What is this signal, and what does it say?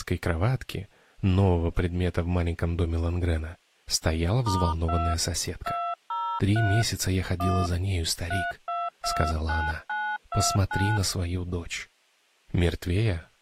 DTMF, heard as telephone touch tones, dialled by hand, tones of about 260 ms. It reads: *2 203 1 3229929